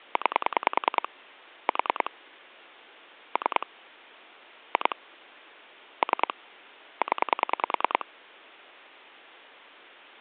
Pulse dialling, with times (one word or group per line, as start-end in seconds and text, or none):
0.2-1.1 9
1.7-2.1 4
3.4-3.7 3
4.7-5.0 2
6.0-6.3 3
7.0-8.1 0